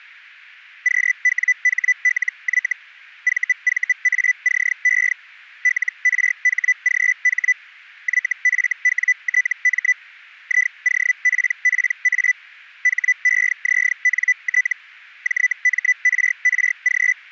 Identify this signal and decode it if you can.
Hellschreiber (Feld-Hell, 122.5 baud), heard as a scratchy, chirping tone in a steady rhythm, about 2000 Hz. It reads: QWHLY VVACE LRHGH YFWTM IOPPA HEZNT JMRRG